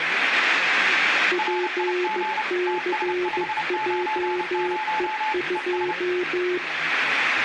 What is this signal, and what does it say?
Morse code, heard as two keyed tones, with radio static and speech in Nepali. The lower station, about 15 wpm, 360 Hz: PCJE2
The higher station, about 30 wpm, 860 Hz: RIG TS590 ES